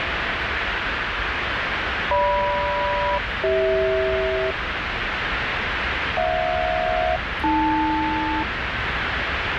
Aircraft SELCAL, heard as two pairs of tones, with radio static and the noise inside a subway train. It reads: GM-CH HJ-AL